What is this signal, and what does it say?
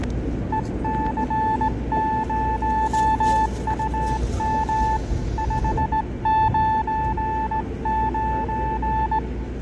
Morse code, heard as a keyed tone, hand-sent with a straight key, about 18 wpm, 880 Hz, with fading and the noise inside a subway train. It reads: EC0UM 599